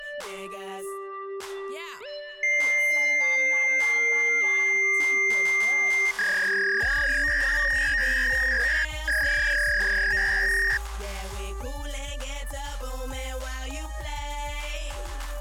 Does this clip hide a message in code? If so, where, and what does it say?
Yes: fax machine handshake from 2.4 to 10.8 s, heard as a long tone and a warble.